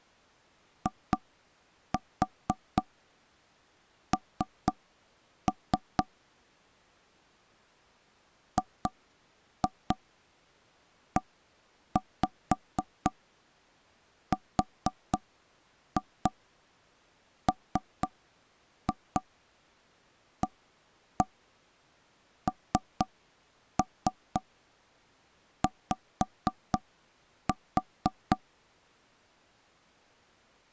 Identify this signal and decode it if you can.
Tap code, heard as knocks on wood, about 4 knocks a second. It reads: IN GERMANY